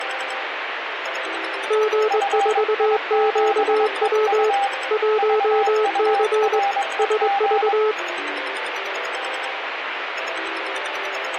Morse code, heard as two keyed tones, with radio static. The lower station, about 21 wpm, 430 Hz: G4QW 1C SV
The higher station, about 22 wpm, 800 Hz: FI7EU VUREG